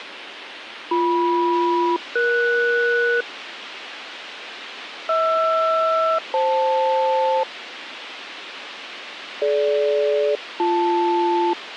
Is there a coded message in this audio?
Yes: aircraft SELCAL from 0.9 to 11.5 s, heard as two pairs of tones, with radio hiss. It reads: BM-ES HR-FL DG-BL